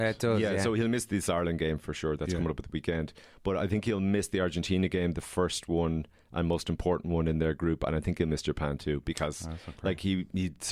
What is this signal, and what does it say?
Speech in English. There is no code.